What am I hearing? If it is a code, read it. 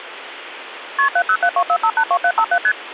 Multi-frequency trunk signalling (R1, as on North American trunks), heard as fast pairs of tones, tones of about 70 ms, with phone line noise. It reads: KP 70724582757 ST